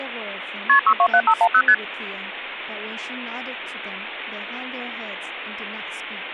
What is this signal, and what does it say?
Multi-frequency trunk signalling (R1, as on North American trunks), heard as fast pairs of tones, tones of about 70 ms, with phone line noise and speech in English. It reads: KP 627510 ST